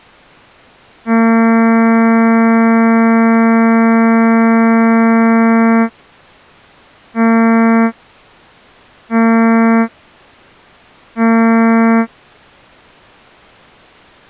Ship horn signal, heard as a ship's horn, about 230 Hz. 1 long, 3 short. At sea: a vessel under tow in fog.